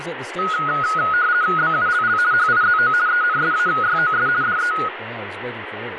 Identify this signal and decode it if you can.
RTTY (50 baud, 170 Hz shift), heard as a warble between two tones, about 1360 Hz centre, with radio static and speech in English. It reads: BULL HIZO ENSAYOS DE